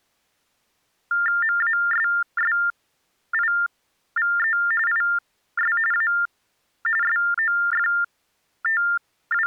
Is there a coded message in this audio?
Yes: TTY/TDD text telephone tones (45.45 baud Baudot) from 1.1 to 9.5 s, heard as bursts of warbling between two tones, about 400 Hz shift, 1600 Hz centre. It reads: MASSIVE IS A …